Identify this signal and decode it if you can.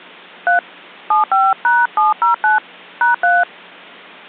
DTMF, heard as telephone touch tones, dialled by hand, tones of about 160 ms. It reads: 3 75#709 #3